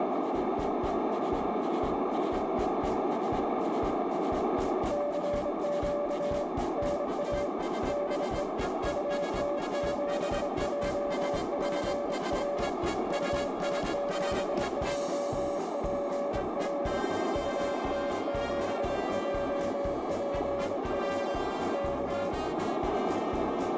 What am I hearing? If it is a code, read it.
Morse code, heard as a keyed tone, hand-sent with a straight key, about 25 wpm, 570 Hz, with radio static and a narrow filter. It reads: CQ NA DE UT7JPR UT7JPR UT7JPR K